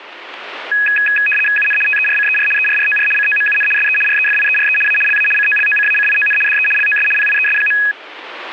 RTTY (75 baud, 850 Hz shift), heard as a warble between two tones, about 2100 Hz centre. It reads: UN TERCER ERROR COMUN SE REFIERE A LA COLOCACION DE LOS PIES.